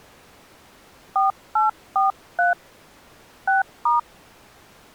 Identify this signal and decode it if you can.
DTMF, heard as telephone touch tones, dialled by hand, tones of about 150 ms. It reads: 4843 6*